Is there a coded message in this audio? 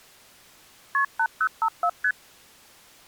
Yes: multi-frequency trunk signalling (R1, as on North American trunks) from 0.9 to 2.1 s, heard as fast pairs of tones, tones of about 70 ms. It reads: KP 8054 ST